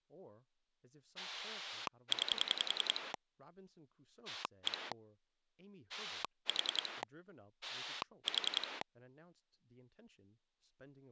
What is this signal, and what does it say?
Pulse dialling, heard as a rotary dial, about 10 pulses a second, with speech in English. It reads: 9 1 4 4